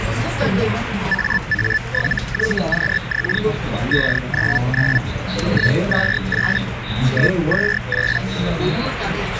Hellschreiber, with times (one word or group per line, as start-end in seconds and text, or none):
1.1-3.4 AA7YQX
3.9-5.0 599
5.5-6.6 128
7.1-8.2 128